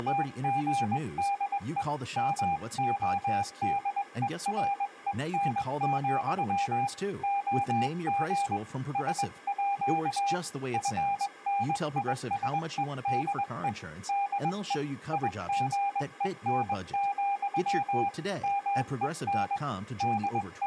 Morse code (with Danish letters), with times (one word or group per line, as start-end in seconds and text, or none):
0.0-1.8 …
2.2-6.9 MODEREN,
7.2-8.6 OG
9.0-10.3 SÅ
10.7-13.7 FNISEDE
14.1-14.7 DE
15.1-18.1 IGEN,
18.4-19.6 MEN
20.0-20.7 …